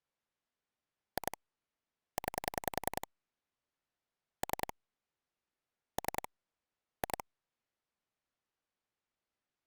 Pulse dialling, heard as clicks on a phone line, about 10 pulses a second. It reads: 2 9 3 3 2